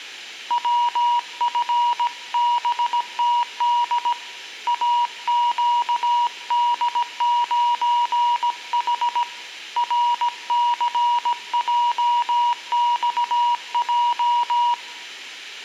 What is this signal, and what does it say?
Morse code, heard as a keyed tone, hand-sent with a paddle, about 17 wpm, 960 Hz, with room echo. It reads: WFBTD AQD9H RCJXJ